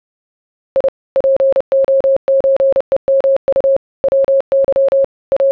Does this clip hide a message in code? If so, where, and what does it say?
Yes: Morse code (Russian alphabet) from 0.7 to 5.5 s, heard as a keyed tone, machine-sent, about 30 wpm, 540 Hz. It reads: И ПОЧЕМУ ВЫ …